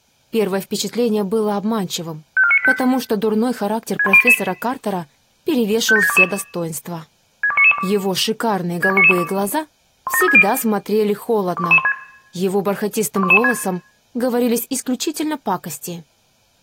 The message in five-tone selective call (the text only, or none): 54985 61088 57622 62992 62992 17360 21116 21116